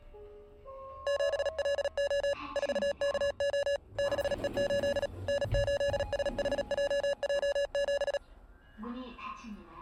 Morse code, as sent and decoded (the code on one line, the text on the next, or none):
--... .-.. --- / ....- -.- --- / -.... . ---.. / -. ---.. ... .... .--- .--- --...
7LO 4KO 6E8 N8SHJJ7